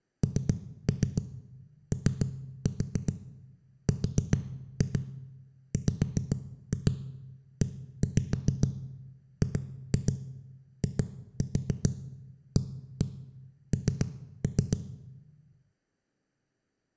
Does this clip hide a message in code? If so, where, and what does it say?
Yes: tap code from 0.2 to 14.8 s, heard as knocks on a wall, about 7 knocks a second, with room echo. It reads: NORWEGIAN